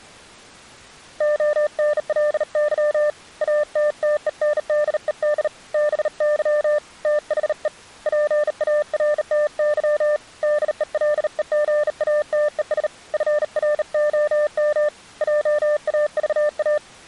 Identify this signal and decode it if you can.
Morse code, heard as a keyed tone, hand-sent with a bug key, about 38 wpm, 600 Hz. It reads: ONLY ATTENDED BY THE PARTY DELEGATES FROM JAVA